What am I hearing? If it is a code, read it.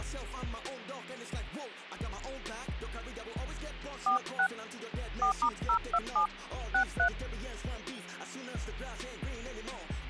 DTMF, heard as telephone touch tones, dialled by hand, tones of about 100 ms. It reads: 46 4*027 63